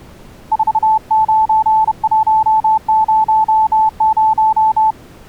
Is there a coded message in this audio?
Yes: Morse code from 0.5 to 5.0 s, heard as a keyed tone, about 31 wpm, 870 Hz. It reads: 49100